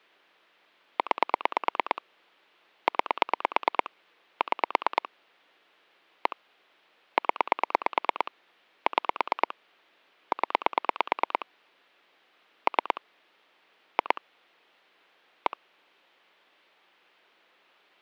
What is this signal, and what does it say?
Pulse dialling, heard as clicks on a phone line, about 9 pulses a second. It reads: 9 9 6 1 0 6 0 3 2 1